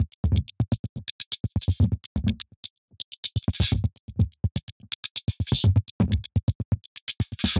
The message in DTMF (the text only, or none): none